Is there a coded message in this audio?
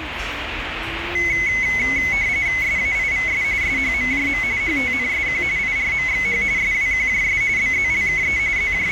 Yes: RTTY (45.45 baud, 170 Hz shift) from 1.1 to 8.9 s, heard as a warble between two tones, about 2100 Hz centre, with radio static and the noise of a restaurant. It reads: SAIVS SHMJM HTNSQ IRMXH SWQJS BZLKE …